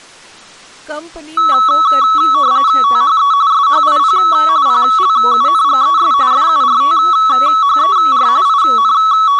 RTTY (45.45 baud, 170 Hz shift), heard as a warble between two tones, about 1210 Hz centre, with speech in Gujarati. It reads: THE SHIP PLUNGES FURTHER …